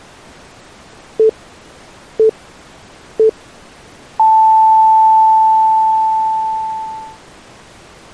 Radio time signal (three low pips and a long one an octave up, as on NHK), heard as pips.